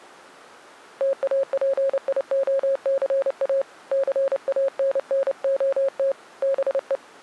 Morse code, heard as a keyed tone, hand-sent with a paddle, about 29 wpm, 540 Hz. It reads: TAPIOCA CANNOT BE